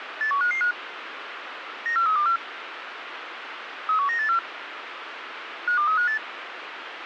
Five-tone selective call (CCIR), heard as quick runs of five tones, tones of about 100 ms, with radio hiss. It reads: 81555 94324 31984 52358